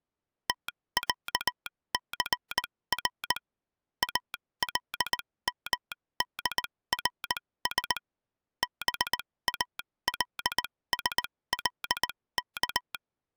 Morse code (Arabic alphabet), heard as a telegraph sounder, machine-sent, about 19 wpm, spaced as for 16 wpm. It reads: تعثر المدرس بالسلك